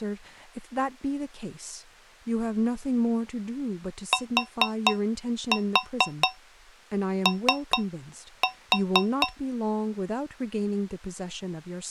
Tap code, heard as taps on a metal pipe, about 4 knocks a second, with speech in English. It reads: TO